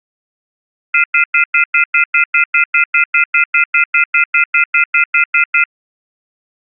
Telephone call progress tone (North American plan), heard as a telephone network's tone, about 1400, 2050, 2450, 2600 Hz, 0.1 s on and 0.1 s off. Off-hook warning tone.